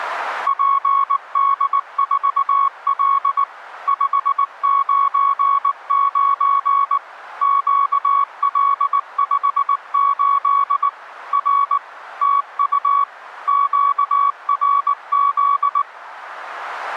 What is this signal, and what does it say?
Morse code, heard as a keyed tone, machine-sent, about 19 wpm, 1120 Hz. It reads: PD4L 599 QL58 R TU QRZ